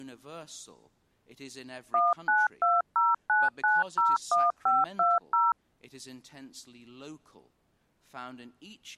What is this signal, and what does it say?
DTMF, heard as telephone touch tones, dialled by machine, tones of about 190 ms, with speech in English. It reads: 19209901520